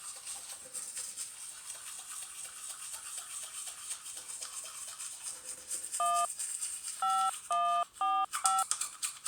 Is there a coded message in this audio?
Yes: DTMF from 6.0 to 8.6 s, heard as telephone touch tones, dialled by hand, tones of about 250 ms, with the noise of a restroom. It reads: 1 5145